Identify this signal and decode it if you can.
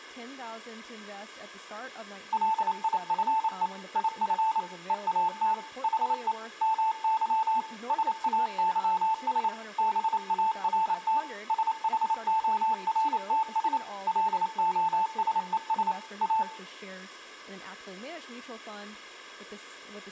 Morse code, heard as a keyed tone, machine-sent, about 28 wpm, 880 Hz, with room echo and speech in English. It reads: LIFE IF EAT HE MY SAYS BART SHORTS LOSES A